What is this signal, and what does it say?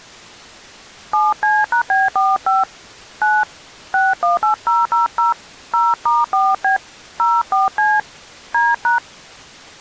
DTMF, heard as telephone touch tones, dialled by hand, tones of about 160 ms. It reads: 7C#B45 9 618000 0*4B 04C D#